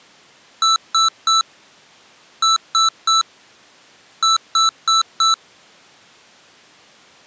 Beep code, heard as beeps from a small speaker, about 1320 Hz. 3-3-4. In Phoenix BIOS tables: video failure.